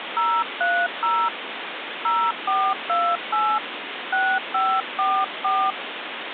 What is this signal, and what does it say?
DTMF, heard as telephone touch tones, dialled by hand, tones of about 260 ms, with phone line noise. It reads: 030 0428 6544